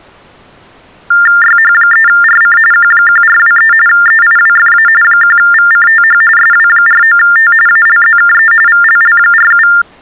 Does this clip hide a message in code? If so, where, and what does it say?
Yes: TTY/TDD text telephone tones (45.45 baud Baudot) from 1.1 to 9.8 s, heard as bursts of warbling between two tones, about 400 Hz shift, 1600 Hz centre. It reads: YH3RC Q1423 EIWFA 1VCTH SW49T ALZKE VLL47